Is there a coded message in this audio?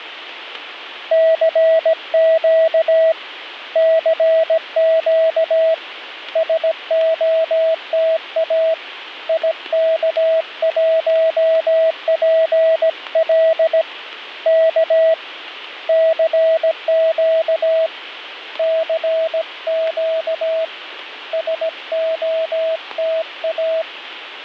Yes: Morse code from 1.1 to 23.9 s, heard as a keyed tone, hand-sent with a paddle, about 17 wpm, 650 Hz. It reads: CQ CQ SOTA IK1PL K CQ CQ SOTA